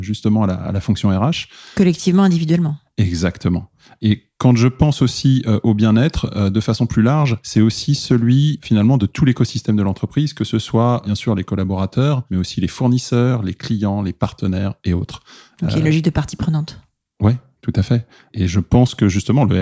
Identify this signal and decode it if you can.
Speech in French. There is no code.